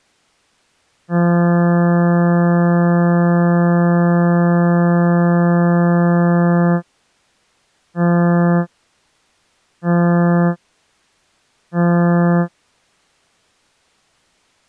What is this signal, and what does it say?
Ship horn signal, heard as a ship's horn, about 170 Hz. 1 long, 3 short. At sea: a vessel under tow in fog.